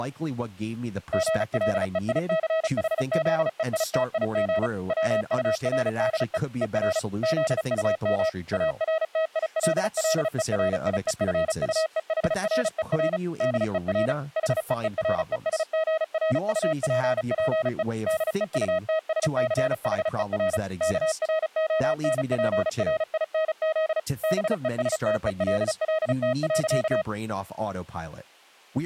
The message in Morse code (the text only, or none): GLEICHZEITIG WURDE ER ZUM ARTILLERIEFUEHRER DER HEERESGRUPPE DEUTSCHER KRONPRINZ BESTELLT.